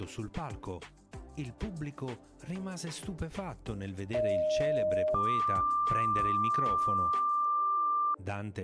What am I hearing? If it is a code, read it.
Two-tone page, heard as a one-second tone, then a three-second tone, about 620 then 1180 Hz.